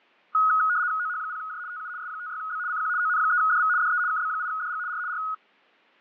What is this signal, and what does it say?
RTTY (75 baud, 170 Hz shift), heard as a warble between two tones, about 1360 Hz centre, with fading. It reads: OH0J TU S56B CQ ON3DV DE KB8DG R R